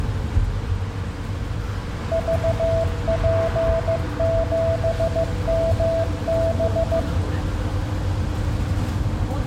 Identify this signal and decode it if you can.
Morse code, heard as a keyed tone, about 15 wpm, 660 Hz, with the noise inside a bus. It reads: VP7MB